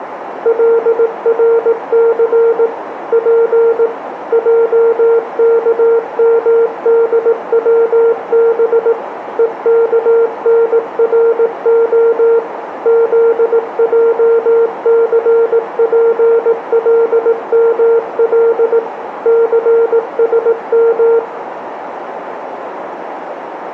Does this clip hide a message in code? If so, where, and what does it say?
Yes: Morse code (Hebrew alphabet) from 0.4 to 21.2 s, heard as a keyed tone, machine-sent, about 18 wpm, 460 Hz, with radio static, a narrow filter and room echo. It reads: לרס פ עכמדצב וכנרה זעספלמל סשם